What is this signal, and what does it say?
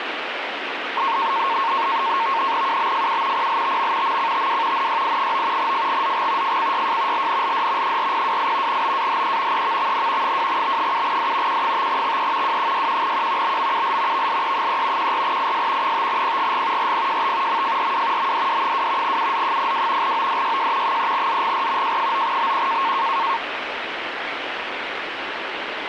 NAVTEX (SITOR-B), 100 baud, 170 Hz shift, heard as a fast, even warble, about 1000 Hz centre, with radio static. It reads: UBFU PLTM MCTW NYI9 FGZG FCYJ LNLD 4028 BAHE EVXN 2B7D Q5XE W61Q BMUL VLE3 14IS 5PGG RPJT MFRW MDD2 UZ02 ODYJ 3ZGR J9BQ